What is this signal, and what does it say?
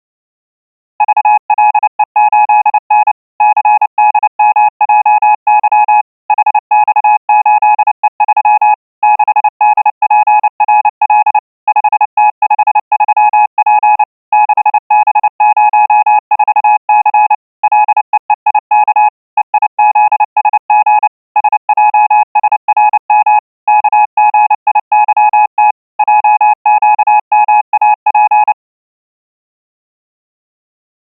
Morse code, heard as a keyed tone, machine-sent, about 29 wpm, 840 Hz. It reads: VLE8N CDMJY HX8E3 6DPRL 5T53P 6B04C LEEIK EIZSG SJSRM KGIYT JQMAP